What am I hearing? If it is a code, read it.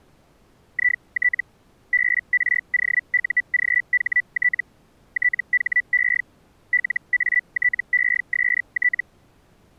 Hellschreiber (Feld-Hell, 122.5 baud), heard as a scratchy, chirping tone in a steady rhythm, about 1950 Hz. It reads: IT BROUGHT THE LATEST